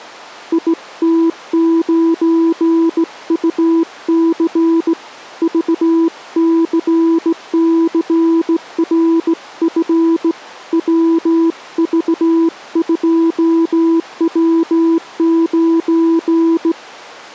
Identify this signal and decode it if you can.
Morse code, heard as a keyed tone, hand-sent with a straight key, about 17 wpm, 330 Hz. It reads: IT9UC VCCRF WV2W9